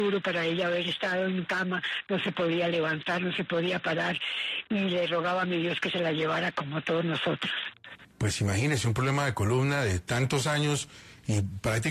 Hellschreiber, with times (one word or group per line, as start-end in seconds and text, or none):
none